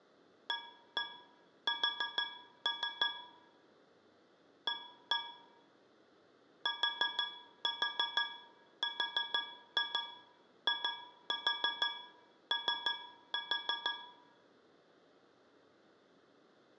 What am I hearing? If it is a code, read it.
Tap code, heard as taps on a metal pipe, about 6 knocks a second, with room echo. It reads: AS A TRIO